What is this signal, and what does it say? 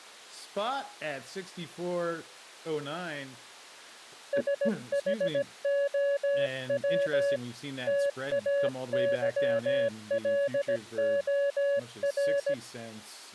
Morse code, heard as a keyed tone, hand-sent with a paddle, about 17 wpm, 560 Hz. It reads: SHOW TAYLOR